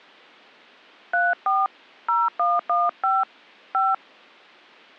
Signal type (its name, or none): DTMF